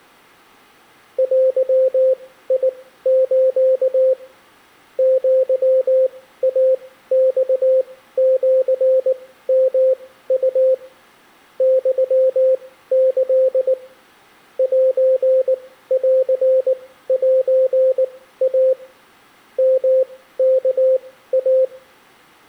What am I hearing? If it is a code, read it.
Morse code (Japanese Wabun code), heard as a keyed tone, machine-sent, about 19 wpm, spaced as for 14 wpm, 520 Hz. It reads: デス アイマシヨウ ユキ センセイ ヨワイ